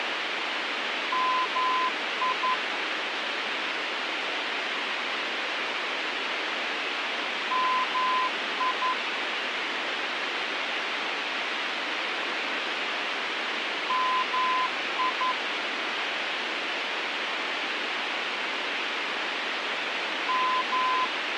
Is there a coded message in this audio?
Yes: Morse code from 1.1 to 21.4 s, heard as a keyed tone, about 11 wpm, 1020 Hz, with radio hiss. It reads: MI MI MI …